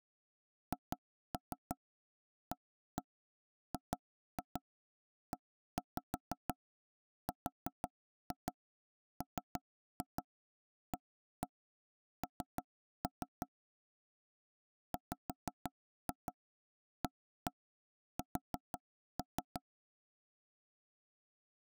Tap code, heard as knocks on wood, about 6 knocks a second. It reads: HAGERMAN WAS